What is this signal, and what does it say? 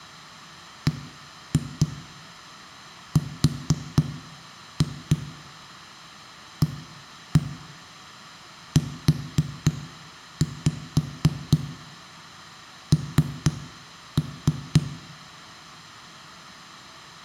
Tap code, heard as knocks on a wall, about 3 knocks a second, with room echo. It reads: BRAUN